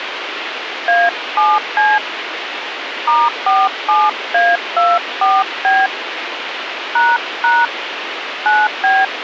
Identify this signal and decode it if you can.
DTMF, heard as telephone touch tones, dialled by hand, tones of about 210 ms, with radio hiss. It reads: A7C *47A24B ## 9B